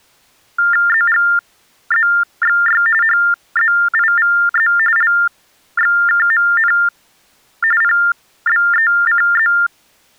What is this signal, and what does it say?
TTY/TDD text telephone tones (45.45 baud Baudot), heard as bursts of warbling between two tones, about 400 Hz shift, 1600 Hz centre. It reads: ZGZXY HZIVZ LXKMN PBECZ